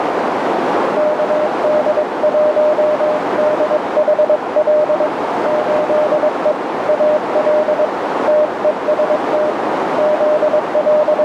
Morse code, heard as a keyed tone, hand-sent with a paddle, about 22 wpm, 610 Hz, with heavy radio static and a narrow filter. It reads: KD1DHL 8E AL TEST …